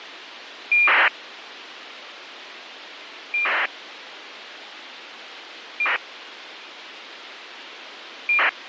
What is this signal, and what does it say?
ACARS aircraft data, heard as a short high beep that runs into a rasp, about 2400 baud, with radio hiss.